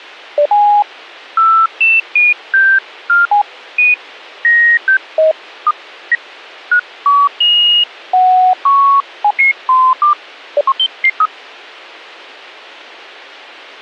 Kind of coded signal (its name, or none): none